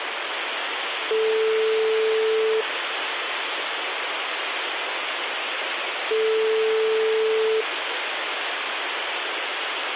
Telephone call progress tone (single-tone plan, as in most of Europe), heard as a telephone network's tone, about 440 Hz, 1.5 s on and 3.5 s off, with phone line noise. Ringback tone.